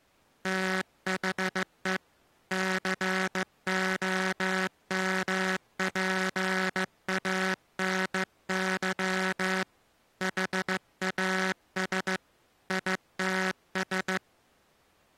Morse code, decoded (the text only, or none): THE COMPANY HAS ITS